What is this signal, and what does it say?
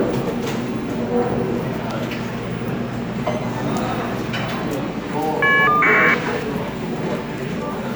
Caller ID data burst, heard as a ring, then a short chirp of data, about 1200 baud, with the noise of a cafe.